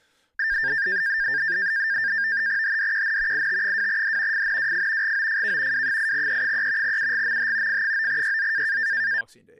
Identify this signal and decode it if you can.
NAVTEX (SITOR-B), 100 baud, 170 Hz shift, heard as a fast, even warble, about 1700 Hz centre, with speech in English. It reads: HDQN IT2D FNWF GOFK W8E3 UGMH F9YZ